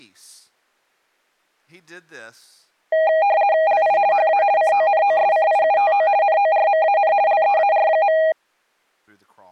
RTTY (50 baud, 170 Hz shift), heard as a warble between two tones, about 720 Hz centre, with speech in English. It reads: LI HA CONOSCIUTO NORMAN LEAR.